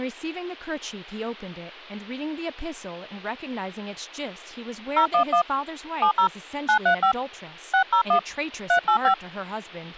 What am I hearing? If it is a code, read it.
DTMF, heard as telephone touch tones, dialled by hand, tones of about 90 ms, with speech in English. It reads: 011 70 935 601 385